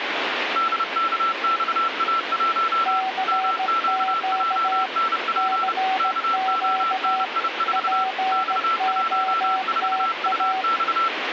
Morse code, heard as two keyed tones, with radio static. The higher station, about 30 wpm, 1340 Hz: DKXA1 MQJNP KONI4 X14UX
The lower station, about 17 wpm, 760 Hz: CQ CQ POTA